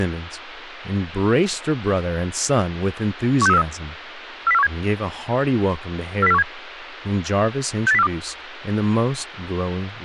Five-tone selective call (EEA), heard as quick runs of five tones, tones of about 40 ms, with radio hiss and speech in English. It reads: 16343 40417 40417 68042